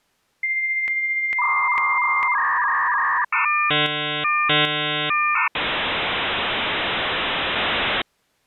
Dial-up modem handshake (V.34 or later), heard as a whistle, warbles, then hiss.